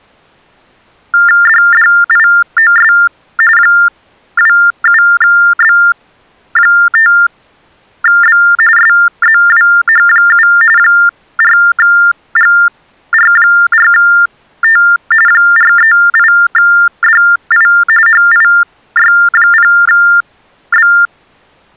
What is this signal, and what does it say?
TTY/TDD text telephone tones (45.45 baud Baudot), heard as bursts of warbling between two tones, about 400 Hz shift, 1600 Hz centre. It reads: DDIOS 27B5B SZWH7 4GR4T 438DI HIY0B